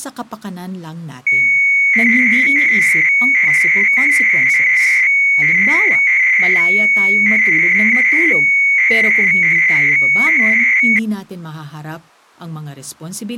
300-baud modem data (Bell 103 tones), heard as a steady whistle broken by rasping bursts, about 300 baud, 200 Hz shift, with speech in Filipino.